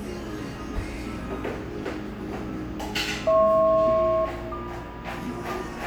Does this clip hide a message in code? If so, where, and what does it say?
Yes: aircraft SELCAL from 3.3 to 5.5 s, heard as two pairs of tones, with radio static, fading, room echo and the noise of a cafe. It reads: HP-MQ